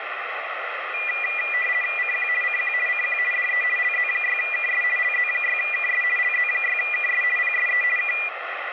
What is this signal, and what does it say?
RTTY (50 baud, 450 Hz shift), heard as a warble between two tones, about 2200 Hz centre, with radio static. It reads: CQ CQ CQ DE LZ6KS LZ6KS LZ6KS PSE K